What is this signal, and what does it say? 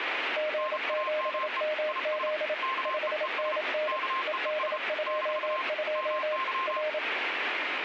Morse code, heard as two keyed tones, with radio static. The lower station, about 27 wpm, 610 Hz: G7MZ 5NN ED22 R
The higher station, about 34 wpm, 1060 Hz: NAME IS KEES KEES - MY